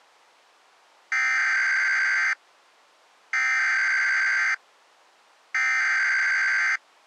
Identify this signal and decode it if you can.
Emergency Alert System (SAME) tones (header bursts), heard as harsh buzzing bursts, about 520.83 baud.